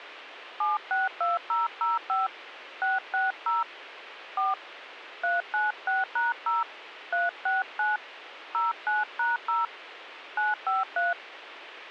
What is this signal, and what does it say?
DTMF, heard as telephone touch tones, dialled by hand, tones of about 170 ms, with radio hiss. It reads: 762005 660 4 396#0 369 09#0 953